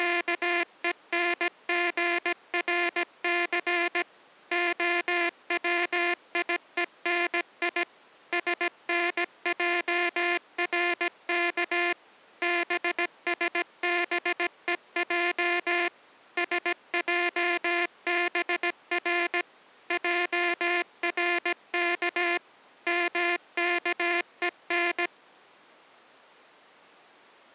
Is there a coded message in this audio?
Yes: Morse code (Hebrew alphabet) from 0.0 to 25.1 s, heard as a buzzer, machine-sent, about 17 wpm. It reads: … הציוני שנערך בשבוע שעבר ערך מכון